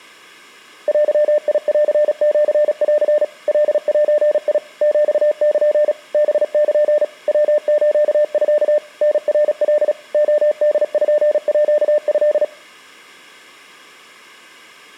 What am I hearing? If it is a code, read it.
Morse code (Japanese Wabun code), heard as a keyed tone, machine-sent, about 36 wpm, 600 Hz. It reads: デンシン カゼ ヒル ハル ヤスミ タナカ レポート